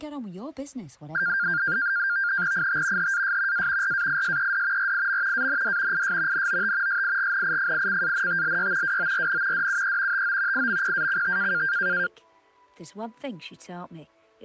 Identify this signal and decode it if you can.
NAVTEX (SITOR-B), 100 baud, 170 Hz shift, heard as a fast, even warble, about 1500 Hz centre. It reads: IT HAS A RAISED RIM AND IS NOT SIGNIFICANTLY WORN DUE TO IMPACT